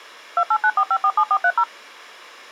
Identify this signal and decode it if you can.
DTMF, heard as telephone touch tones, dialled by machine, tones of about 60 ms. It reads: 2894547430